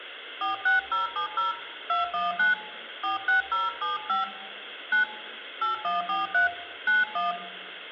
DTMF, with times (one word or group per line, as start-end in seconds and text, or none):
0.4-1.5 46070
1.9-2.5 219
3.0-4.2 46075
4.9-5.0 9
5.6-6.5 8143
6.9-7.3 91